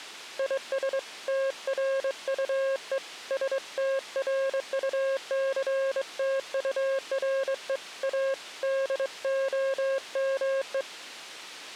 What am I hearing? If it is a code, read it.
Morse code, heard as a keyed tone, hand-sent with a straight key, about 23 wpm, 540 Hz. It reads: IS TRUE STRUCTURE A DOME